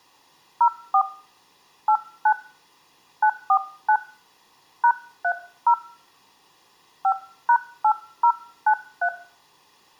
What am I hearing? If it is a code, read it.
DTMF, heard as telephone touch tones, dialled by hand, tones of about 80 ms. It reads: 04 89 949 #30 5#8093